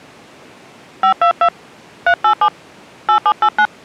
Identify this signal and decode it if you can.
DTMF, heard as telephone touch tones, dialled by hand, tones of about 70 ms. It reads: 522 387 8789